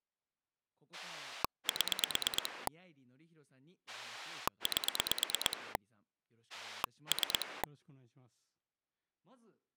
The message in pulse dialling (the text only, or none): 7 8 3